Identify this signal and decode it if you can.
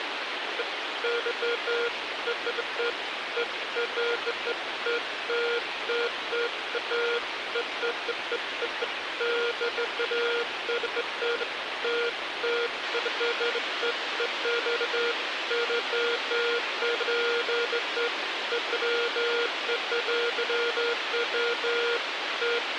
Beeps of irregular length, with radio hiss. There is no code.